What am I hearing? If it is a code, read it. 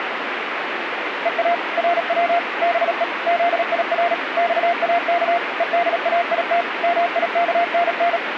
Morse code (Persian alphabet), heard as a keyed tone, machine-sent, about 37 wpm, 690 Hz, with radio static. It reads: ها رو به زیر خاک هدایت میکنن